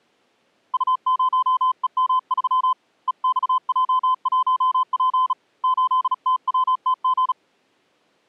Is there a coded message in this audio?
Yes: Morse code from 0.7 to 7.4 s, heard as a keyed tone, hand-sent with a bug key, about 36 wpm, 1020 Hz. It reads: U0EM3 EXJ1P 8TWTG